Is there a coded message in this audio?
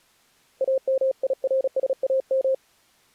Yes: Morse code (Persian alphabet) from 0.6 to 2.6 s, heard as a keyed tone, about 36 wpm, 530 Hz. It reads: امیرسام